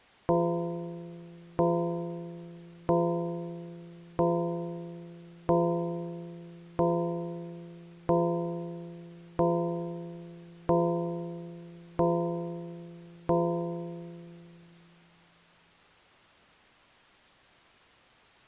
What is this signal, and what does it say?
Clock strike, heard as a bell. 11. Eleven o'clock.